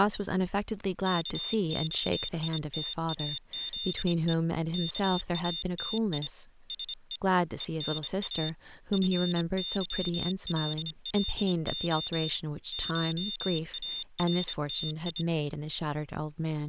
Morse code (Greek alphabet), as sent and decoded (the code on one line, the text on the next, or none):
-.- --- .. - .- --.. . / -.- .- - .. / ... . / . -. .- / ..-. -.-- .-.. .-.. --- / ---- .- .-. - ..
ΚΟΙΤΑΖΕ ΚΑΤΙ ΣΕ ΕΝΑ ΦΥΛΛΟ ΧΑΡΤΙ